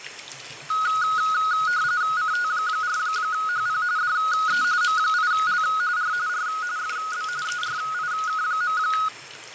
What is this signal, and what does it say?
RTTY (45.45 baud, 170 Hz shift), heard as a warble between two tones, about 1360 Hz centre, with radio static, fading and the noise of a restroom. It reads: CT4HP DE M8L R R FB ERIK.